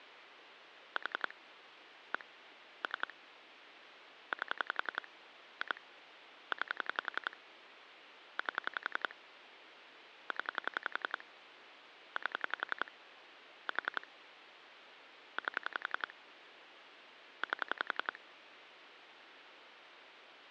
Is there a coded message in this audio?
Yes: pulse dialling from 1.0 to 18.2 s, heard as clicks on a phone line, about 11 pulses a second, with phone line noise. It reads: 4 1 3 8 2 9 8 0 8 4 8 8